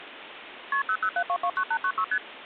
Multi-frequency trunk signalling (R1, as on North American trunks), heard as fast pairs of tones, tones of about 70 ms, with phone line noise. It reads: KP 007229896 ST